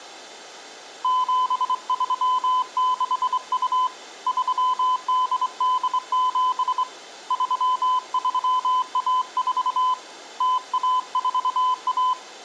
Morse code (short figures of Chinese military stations), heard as a keyed tone, hand-sent with a straight key, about 24 wpm, 1010 Hz. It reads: 7362 3887 3314 0141